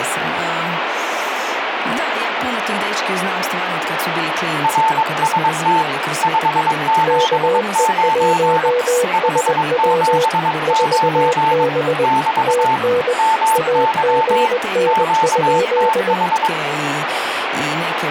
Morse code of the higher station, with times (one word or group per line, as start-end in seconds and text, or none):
4.6-5.8 RST
6.2-8.7 579
9.1-11.6 579
12.0-12.8 <BT>
13.2-14.5 MY
14.9-16.5 QTH